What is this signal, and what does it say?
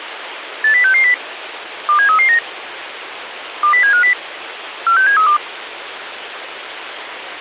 Five-tone selective call (CCIR), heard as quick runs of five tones, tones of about 100 ms, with radio hiss. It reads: 80660 27339 20750 46732